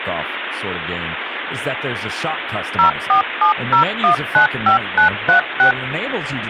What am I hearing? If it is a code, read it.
DTMF, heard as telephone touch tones, dialled by machine, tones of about 110 ms, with phone line noise and speech in English. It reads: 0470195936